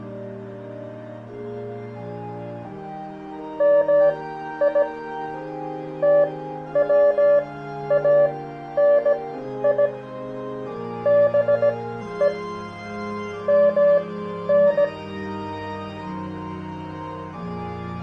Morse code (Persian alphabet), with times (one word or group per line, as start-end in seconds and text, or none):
3.6-4.8 می
6.0-9.9 توانی
11.1-12.3 به
13.5-14.8 من